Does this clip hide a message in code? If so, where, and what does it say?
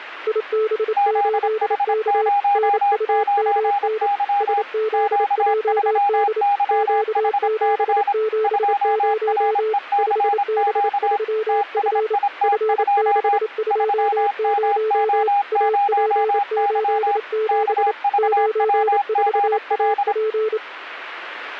Yes: Morse code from 0.2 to 20.6 s, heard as two keyed tones. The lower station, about 28 wpm, 440 Hz: IB8K NUMN SZJD Q770 5B3F F620 AP87 94AP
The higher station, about 26 wpm, 810 Hz: ZH09Y Q3YHC 2RECQ TSIT2 3MO0Y KVWGL